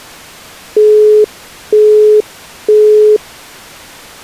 Telephone call progress tone (single-tone plan, as in Europe, Japan and elsewhere), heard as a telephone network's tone, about 420 Hz, 0.48 s on and 0.48 s off. Busy tone.